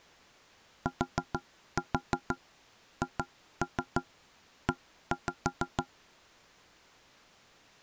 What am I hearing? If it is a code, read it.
Tap code, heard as knocks on wood, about 6 knocks a second. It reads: THE